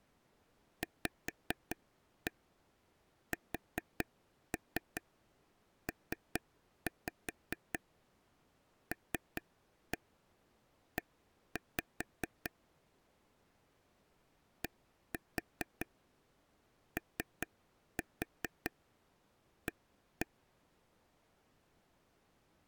Tap code, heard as taps on a table, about 4 knocks a second. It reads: VSPLE DOA